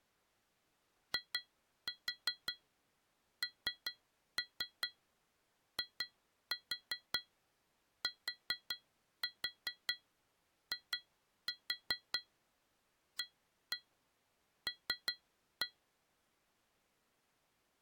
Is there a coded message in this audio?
Yes: tap code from 1.1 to 15.8 s, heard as taps on glass, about 5 knocks a second. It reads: INITIAL